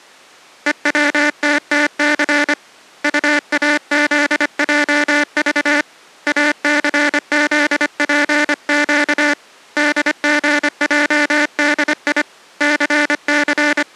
Morse code, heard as a buzzer, hand-sent with a paddle, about 25 wpm. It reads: EWTTC UAZJV ACZPQ DGJDI …